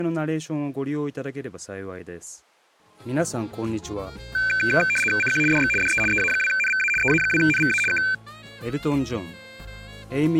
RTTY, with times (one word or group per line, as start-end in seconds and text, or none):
5.2-5.4 CQ
5.5-5.7 DX
5.8-6.0 DE
6.1-6.9 EA2NVA
7.0-7.8 EA2NVA
7.9-8.0 K